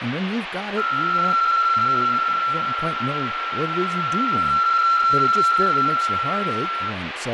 PSK63 (62.5 baud), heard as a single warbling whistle, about 1350 Hz, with radio static, fading and speech in English.